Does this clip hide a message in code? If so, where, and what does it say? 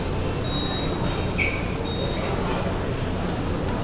No, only the noise of a subway station.